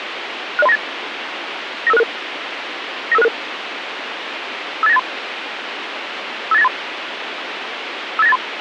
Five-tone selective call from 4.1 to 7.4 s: 58983 58983

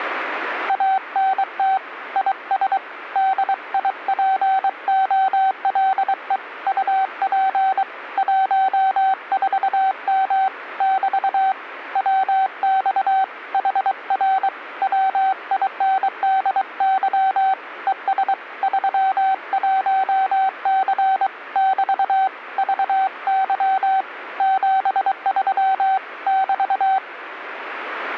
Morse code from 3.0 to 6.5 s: DIPOLE

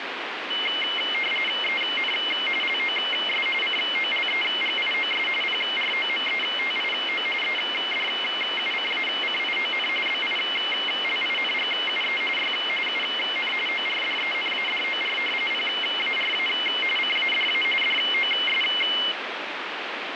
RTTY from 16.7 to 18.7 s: CADA DOS

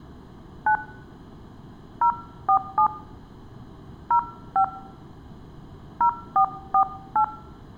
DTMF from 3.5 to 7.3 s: 05 0448

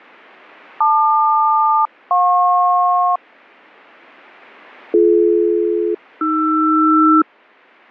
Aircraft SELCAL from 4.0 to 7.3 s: BD-AR

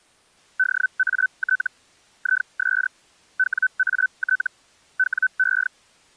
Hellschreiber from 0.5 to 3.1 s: DAT IS

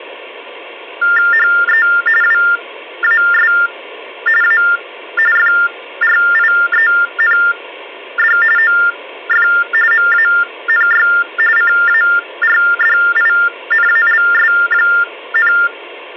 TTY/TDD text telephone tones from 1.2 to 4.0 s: HE WAS

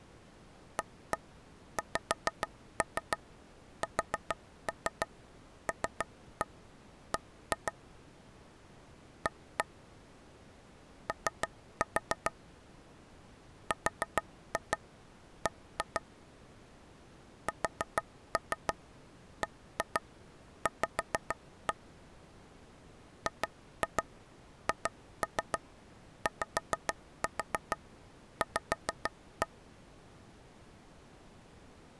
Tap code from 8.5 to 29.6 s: A O RB SBV GHYV

